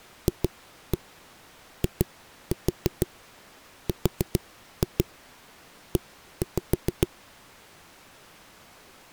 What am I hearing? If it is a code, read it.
Tap code, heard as knocks on a wall, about 6 knocks a second. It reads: FIRE